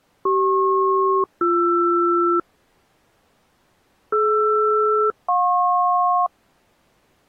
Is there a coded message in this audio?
Yes: aircraft SELCAL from 0.3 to 6.3 s, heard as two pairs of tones. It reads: CP-BR DR-JP